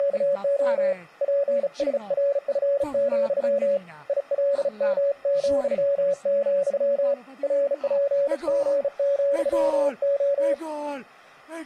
Morse code, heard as a keyed tone, hand-sent with a bug key, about 35 wpm, 560 Hz. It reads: … PSRF, ILM,, RPG,O